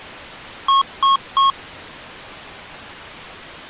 Beep code, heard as beeps from a small speaker, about 1090 Hz. 3 short. In AMI BIOS tables: failure in the first 64 KB of memory; in Dell tables: chipset error.